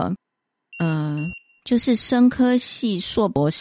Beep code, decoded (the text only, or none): 2 short